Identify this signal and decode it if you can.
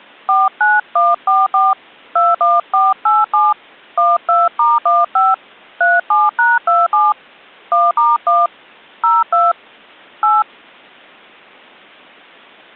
DTMF, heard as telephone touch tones, dialled by hand, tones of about 190 ms. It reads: 49144 21487 12*15 37#27 1*1 02 8